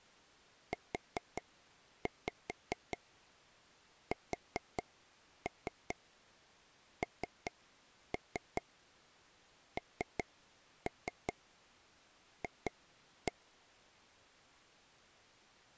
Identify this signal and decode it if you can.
Tap code, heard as taps on a table, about 4 knocks a second. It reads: USNNF